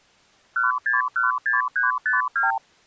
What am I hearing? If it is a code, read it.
Multi-frequency trunk signalling (R2, with the far end's replies), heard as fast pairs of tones, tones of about 150 ms. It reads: 1616352